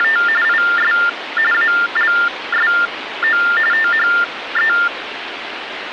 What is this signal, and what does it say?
TTY/TDD text telephone tones (45.45 baud Baudot), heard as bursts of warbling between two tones, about 400 Hz shift, 1600 Hz centre, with phone line noise. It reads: … IS ALSO THE